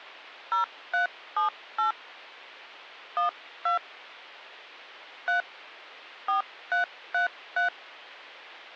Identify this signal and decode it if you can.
DTMF, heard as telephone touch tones, dialled by hand, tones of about 120 ms. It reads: 0378 12 3 4333